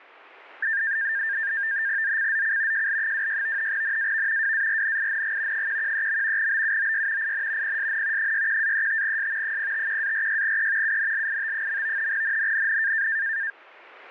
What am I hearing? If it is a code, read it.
NAVTEX (SITOR-B), 100 baud, 170 Hz shift, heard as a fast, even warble, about 1700 Hz centre. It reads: ZCZC JL26 NAV WARNING 113. BUOY IN PSN 61-35S 051-46E UNLIT. NNNN